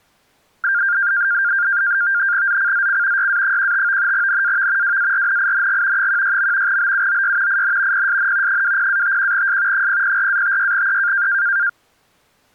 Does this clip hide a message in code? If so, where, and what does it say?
Yes: NAVTEX (SITOR-B), 100 baud, 170 Hz shift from 0.6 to 11.7 s, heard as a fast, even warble, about 1500 Hz centre. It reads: ZCZC YA15 NAV WARNING 16. BUOY IN PSN 20-51S 004-56E